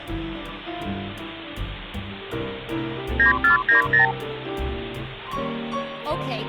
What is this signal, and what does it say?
Multi-frequency trunk signalling (R2, with the far end's replies), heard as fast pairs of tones, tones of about 120 ms. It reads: 9490